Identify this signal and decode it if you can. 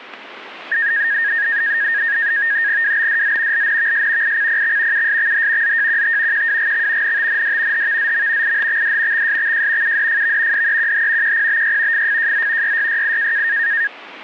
NAVTEX (SITOR-B), 100 baud, 170 Hz shift, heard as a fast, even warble, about 1750 Hz centre, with static crashes. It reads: WBDZ LNVS ICPX USXH ZJQT QWGX NTND HVZM IHXD XSXJ UDFV DEQH QPBY FFJZ YYYI